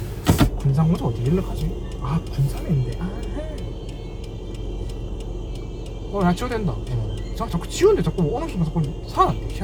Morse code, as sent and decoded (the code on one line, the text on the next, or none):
none